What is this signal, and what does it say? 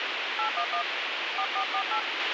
DTMF, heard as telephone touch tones, dialled by hand, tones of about 90 ms, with radio hiss and a squelch burst at the end. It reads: 811 4448